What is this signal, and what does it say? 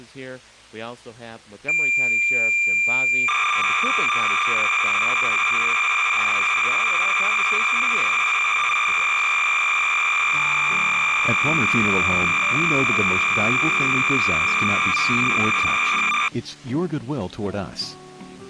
Cassette data (Kansas City type), 300 baud, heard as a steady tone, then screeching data.